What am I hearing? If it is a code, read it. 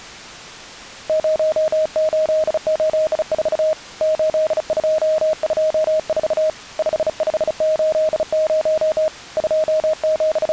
Morse code, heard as a keyed tone, hand-sent with a bug key, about 35 wpm, 630 Hz. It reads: 0884 8224 5580 …